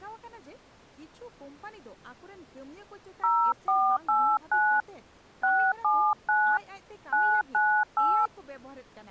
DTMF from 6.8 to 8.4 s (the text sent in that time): 998